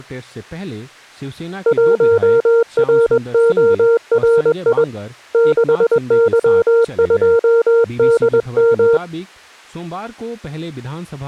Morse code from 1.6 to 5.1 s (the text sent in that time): 1RORI